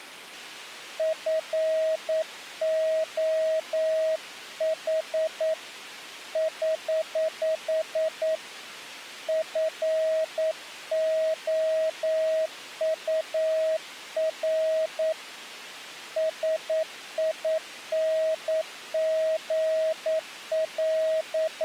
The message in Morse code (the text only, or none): FOH <HH> FOUR …